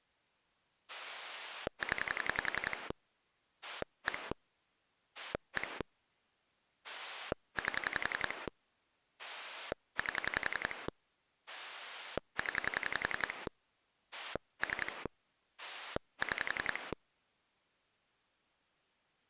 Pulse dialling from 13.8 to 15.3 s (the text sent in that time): 3